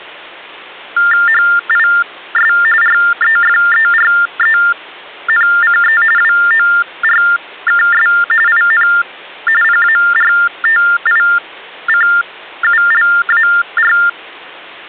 TTY/TDD text telephone tones (45.45 baud Baudot), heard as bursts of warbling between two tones, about 400 Hz shift, 1600 Hz centre, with hum. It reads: HIS REFERENCE WORKS IN PARTICULAR